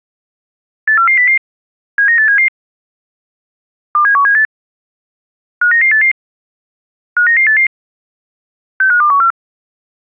Five-tone selective call (CCIR), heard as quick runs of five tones, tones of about 100 ms. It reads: 84400 79877 27178 59988 59988 65214